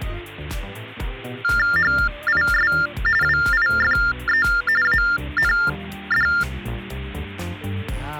TTY/TDD text telephone tones (45.45 baud Baudot), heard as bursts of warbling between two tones, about 400 Hz shift, 1600 Hz centre, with hum. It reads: HIS WIFE AND